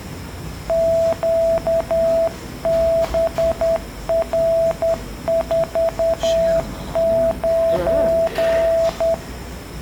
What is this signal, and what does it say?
Morse code, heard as a keyed tone, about 10 wpm, 660 Hz, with the noise of a cafe. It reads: QBR49